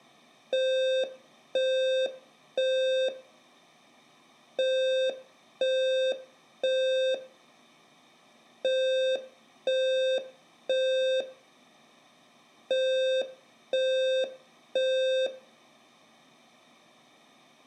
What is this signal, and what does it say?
Alarm pattern, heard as an alarm's beeps, played four times, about 520 Hz. Temporal three. Smoke or fire, evacuate.